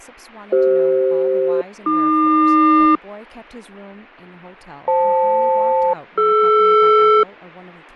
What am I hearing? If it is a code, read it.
Aircraft SELCAL, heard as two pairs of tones, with speech in English. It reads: CF-AQ FL-DR